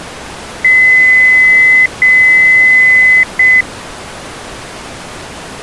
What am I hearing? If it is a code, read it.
Beep code, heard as beeps, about 2000 Hz. 2 long, 1 short.